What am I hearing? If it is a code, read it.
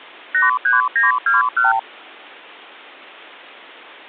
Multi-frequency trunk signalling (R2, with the far end's replies), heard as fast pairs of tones, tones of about 150 ms. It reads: 83921